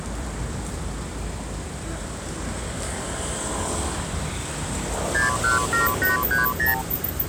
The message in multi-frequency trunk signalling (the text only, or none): 617830